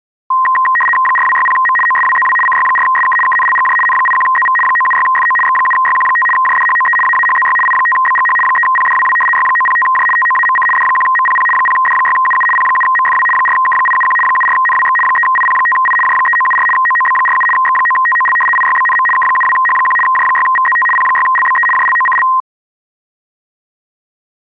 RTTY (75 baud, 850 Hz shift), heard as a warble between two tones, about 1460 Hz centre. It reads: 4260M OSWZW CY4SK KNLGJ N81ZV 976FO X7YQ5 JDHOE AAHZY I5BGH 3PDWW Y905J TOAMC D1MPP 0D6UU P7MFW 4K871 74NWX 3IP5I J3974 OOB47 X9TOL IYBNM K72H1 J6VZT P6LBE JLOCL